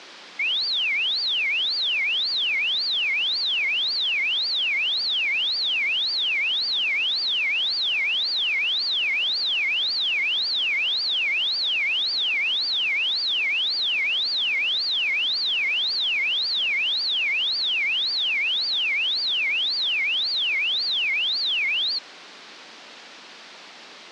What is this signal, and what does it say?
A tone that sweeps in pitch again and again, with phone line noise. There is no code.